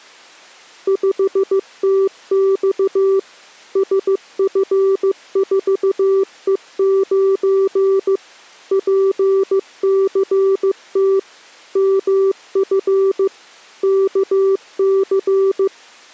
Morse code, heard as a keyed tone, machine-sent, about 15 wpm, 390 Hz. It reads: 5TX SF4E9 PCT MF KC